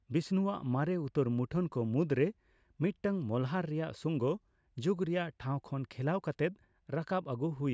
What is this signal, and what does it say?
Speech in Santali. There is no code.